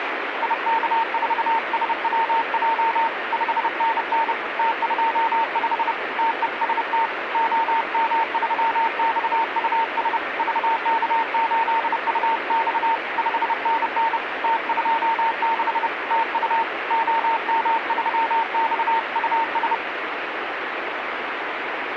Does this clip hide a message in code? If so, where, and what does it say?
Yes: Morse code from 0.4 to 19.8 s, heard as a keyed tone, hand-sent with a paddle, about 30 wpm, 910 Hz, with radio static. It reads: IK4SWJ 5NN T25 TEST OM3XUS VK8UX 5NN T26 TU OM3XUS